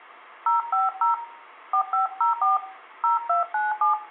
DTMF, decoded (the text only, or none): 050 4504 0297